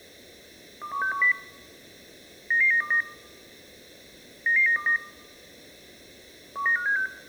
Five-tone selective call (CCIR), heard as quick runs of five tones, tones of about 100 ms. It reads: 21610 99929 99929 19576